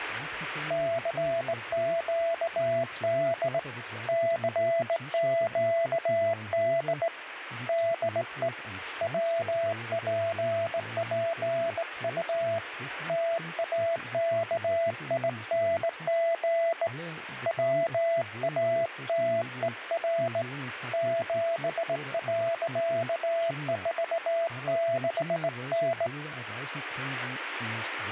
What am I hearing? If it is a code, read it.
Morse code, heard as a keyed tone, hand-sent with a straight key, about 18 wpm, 670 Hz, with radio static. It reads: CQD CQD DE WPPU TAKING WATER 7.46N